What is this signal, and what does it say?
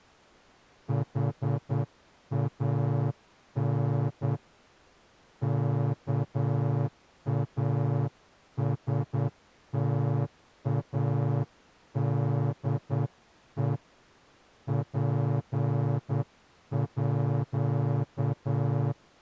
Morse code (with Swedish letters), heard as a horn, hand-sent with a straight key, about 9 wpm. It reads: HAN KASTADE PÅ